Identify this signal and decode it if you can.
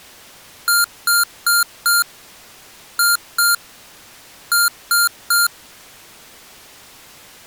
Beep code, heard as beeps from a small speaker, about 1400 Hz. 4-2-3. In Phoenix BIOS tables: gate A20 failure.